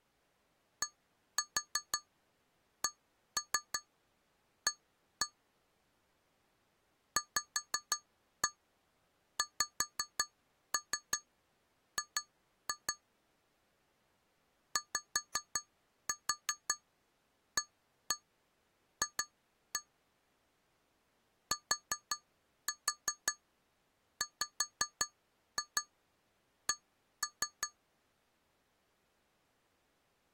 Tap code, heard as taps on glass, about 5 knocks a second. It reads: DCA VXG YAF TWC